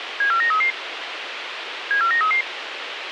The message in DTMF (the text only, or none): none